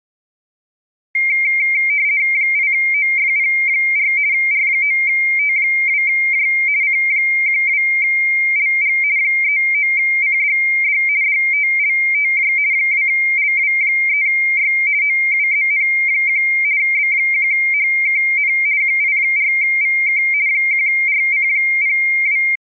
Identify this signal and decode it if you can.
RTTY (50 baud, 170 Hz shift), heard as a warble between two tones, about 2200 Hz centre. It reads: 8OFP4 R9T2J C12LG 39CDD DTLTJ 2LW3Y OUZN1 B1HKN QI4VK 1RC02